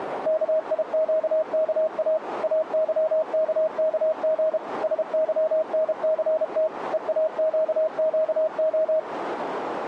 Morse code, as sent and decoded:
-.- .. --.- -.- .- / .- -.-- -.- -.- --. / ... -.-- -. -.-. - / . .- --.- --.- ---
KIQKA AYKKG SYNCT EAQQO

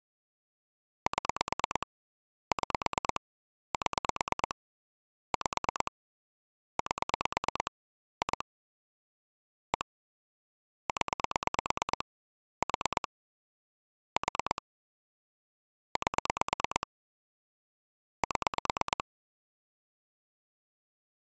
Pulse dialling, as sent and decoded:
7 / 6 / 7 / 5 / 8 / 2 / 1 / 10 / 4 / 4 / 8 / 7
7 6 7 5 8 2 1 0 4 4 8 7

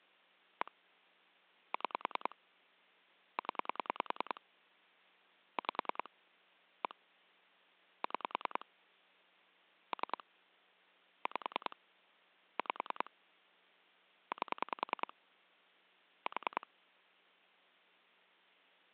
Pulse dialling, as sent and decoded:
1 / 6 / 10 / 5 / 1 / 6 / 3 / 5 / 5 / 8 / 4
1 6 0 5 1 6 3 5 5 8 4

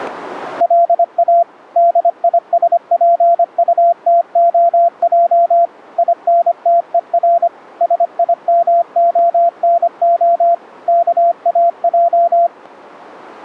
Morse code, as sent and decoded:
.-.. .- / -.. .. ... .--. ..- - --- .--- / .. -. - . .-. / ... .. -- --- -. --- / -.- .- .---
LA DISPUTOJ INTER SIMONO KAJ

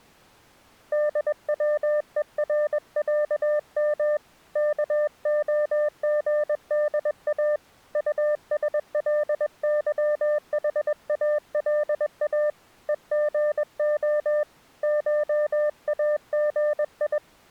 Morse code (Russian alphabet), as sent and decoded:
-.. .-- . .-. .-.- -- / -.- --- --. -.. .- / ..- ... .-.. -.-- .... .- .-.. .- / . --. --- / ---- .- --. ..
ДВЕРЯМ КОГДА УСЛЫХАЛА ЕГО ШАГИ

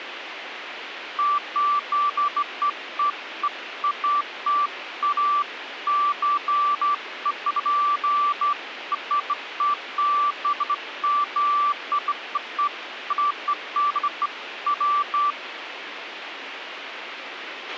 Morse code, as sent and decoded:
none

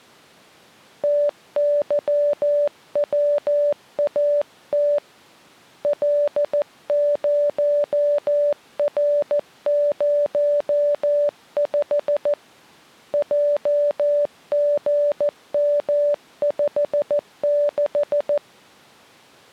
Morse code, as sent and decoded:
- -.-- .-- .- - / .-.. ----- .-. ----- ..... / .--- --. -- ..... -....
TYWAT L0R05 JGM56

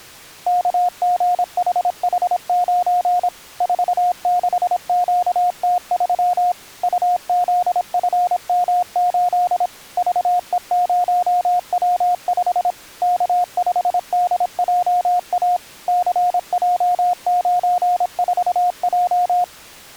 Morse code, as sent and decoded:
-.- --. .... .... ----. / ....- -.... --.- - ...-- / ..- --.. ..-. -- ---.. / ...- . ----- .-- ..... / -.- ..... -.. .--- .- / -.-. .--- ----. ....- .---
KGHH9 46QT3 UZFM8 VE0W5 K5DJA CJ94J

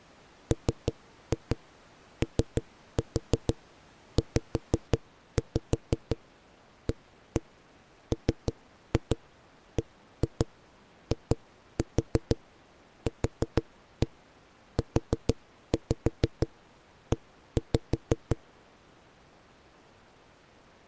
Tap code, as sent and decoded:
3-2 3-4 5-5 1-1 3-2 1-2 2-4 4-1 4-5 1-5
MOZAMBIQUE

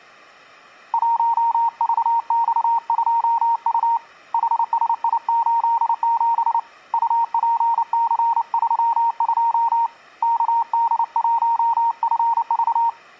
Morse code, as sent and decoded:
.---- ...- -..- ..--- ..- / .... ... .. ---.. --... / ..- .--. -.-. ...-- ..--- / -.- -.. .---- ..-. ...-
1VX2U HSI87 UPC32 KD1FV

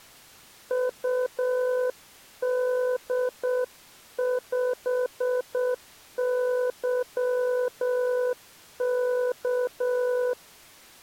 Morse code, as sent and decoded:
..- -.. ..... -.-- -.-
UD5YK

